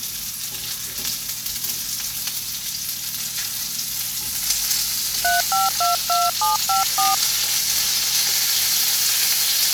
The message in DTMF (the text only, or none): 3522754